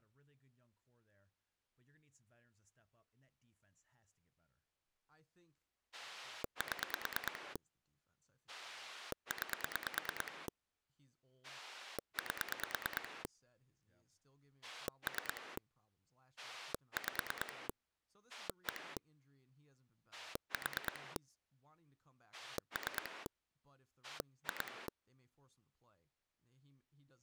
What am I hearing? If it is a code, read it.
Pulse dialling, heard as a rotary dial, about 9 pulses a second, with speech in English. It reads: 7 9 8 3 5 1 4 3 2